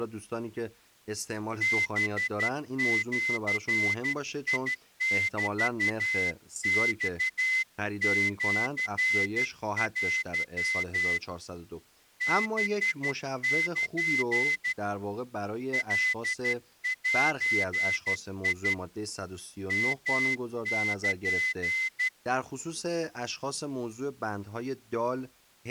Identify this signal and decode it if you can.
Morse code (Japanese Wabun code), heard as a whistle, hand-sent with a straight key, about 12 wpm, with speech in Persian. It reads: ハジメマシテ ハル カゼ ヨル